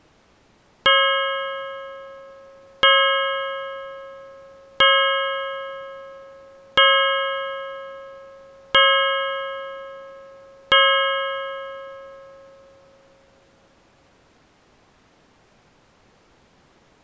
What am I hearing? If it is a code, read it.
Clock strike, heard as a bell. 6. Six o'clock.